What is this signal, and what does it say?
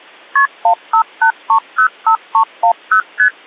Multi-frequency trunk signalling (R1, as on North American trunks), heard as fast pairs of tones, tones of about 90 ms. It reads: KP 158305310 ST